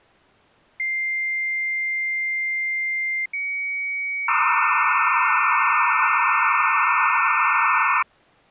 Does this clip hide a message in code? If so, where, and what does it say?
Yes: dial-up modem handshake (low-speed, two carriers) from 0.8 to 8.0 s, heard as two whistles, then hiss.